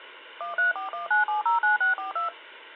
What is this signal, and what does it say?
DTMF, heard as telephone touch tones, dialled by machine, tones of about 130 ms. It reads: 13419709642